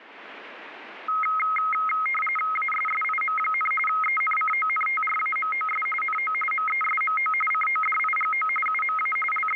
RTTY (45.45 baud, 850 Hz shift), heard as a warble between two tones, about 1700 Hz centre. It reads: ASSIM, ENCONTRAMOS NO MESMO CODIGO UMA …